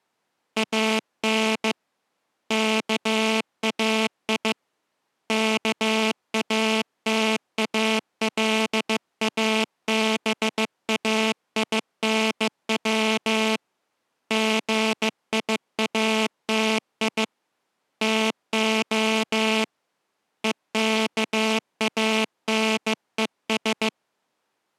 Morse code (Greek alphabet), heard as a buzzer, hand-sent with a bug key, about 15 wpm. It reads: ΑΝ ΚΑΙ ΚΑΤΑΛΑΒΑΙΝΩ ΓΙΑΤΙ ΤΟ ΕΚΑΝΕΣ